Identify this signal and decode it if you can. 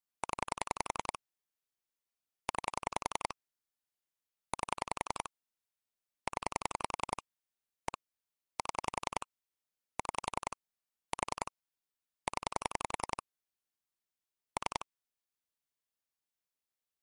Pulse dialling, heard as clicks on a phone line, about 10 pulses a second. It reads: 0 9 8 0 1 7 6 4 0 3